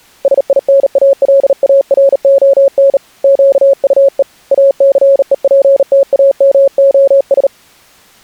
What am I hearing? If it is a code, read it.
Morse code, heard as a keyed tone, hand-sent with a bug key, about 38 wpm, 550 Hz. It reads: SINALARON QUE ACEPTAMOS